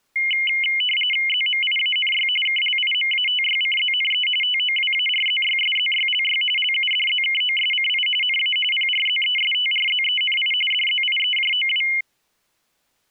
RTTY (45.45 baud, 850 Hz shift), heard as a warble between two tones, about 2550 Hz centre. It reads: ZMIANY KLIMATYCZNE TOWARZYSZYLY LUDZKOSCI NA PRZESTRZENI DZIEJOW